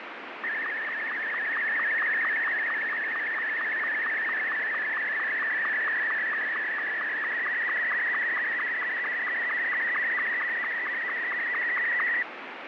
SSTV (slow-scan television), Martin M2, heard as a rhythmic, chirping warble, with radio static.